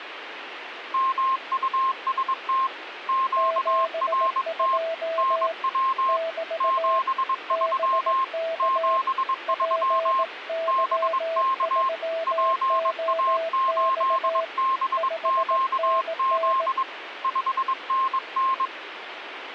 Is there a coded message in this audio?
Yes: Morse code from 0.9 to 18.7 s, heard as two keyed tones, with radio static. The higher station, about 22 wpm, 1060 Hz: MUST QRT NW 73 73 BK PA8BQZ 5NN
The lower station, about 18 wpm, 660 Hz: 72 <BT> BK PY3OX 5NN